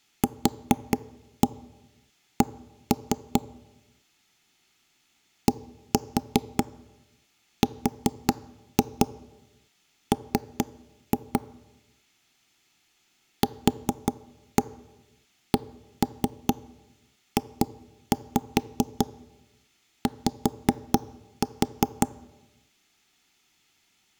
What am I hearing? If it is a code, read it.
Tap code, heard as knocks on wood, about 4 knocks a second. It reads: QC DRM QCJY